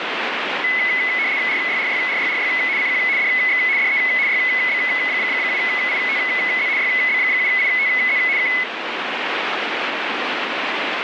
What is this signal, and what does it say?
RTTY (75 baud, 170 Hz shift), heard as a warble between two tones, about 2100 Hz centre, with radio static. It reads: RYRYRYRY CQ DX DE YB7ITZ YB7ITZ K